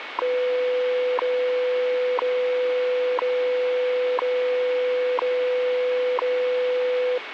Radio time signal (WWV, Colorado), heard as ticks, one a second, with radio static.